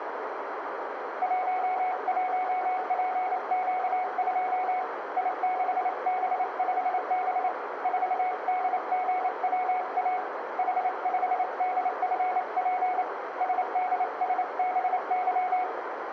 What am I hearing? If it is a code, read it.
Morse code, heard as a keyed tone, hand-sent with a paddle, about 28 wpm, 740 Hz, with radio static, a narrow filter and room echo. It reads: 11PQ2 I6B5B 4DGWA H5DFP SDSBY